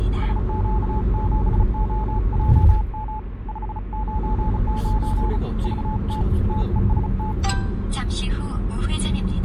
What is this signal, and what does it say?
Morse code, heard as a keyed tone, hand-sent with a bug key, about 35 wpm, 860 Hz, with the noise inside a car. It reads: SQ7OJM 599 VT TEST